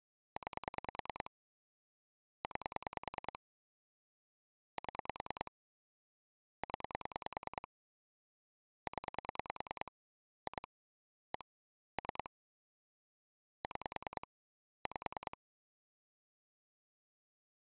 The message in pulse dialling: 9 9 7 0 0 2 1 3 6 5

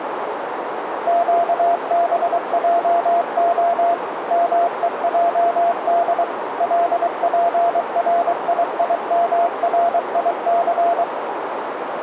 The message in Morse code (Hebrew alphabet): קבעה מועד לפריימריס

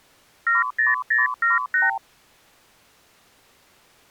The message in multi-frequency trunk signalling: 70078

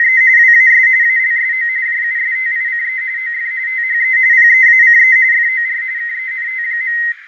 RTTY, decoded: … WAS ALSO JUSTICE OF THE PEACE FOR KENT.

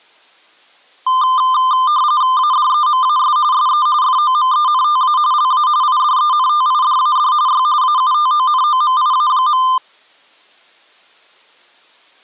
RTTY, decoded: ADEMAS SE FOMENTA LA IDENTIDAD Y AUTONOMIA.

